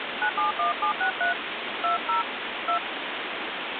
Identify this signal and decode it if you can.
DTMF, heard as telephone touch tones, dialled by hand, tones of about 100 ms, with phone line noise. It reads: 971763 20 2